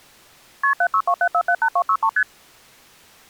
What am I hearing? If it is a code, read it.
Multi-frequency trunk signalling (R1, as on North American trunks), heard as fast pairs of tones, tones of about 70 ms. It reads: KP 7627478263 ST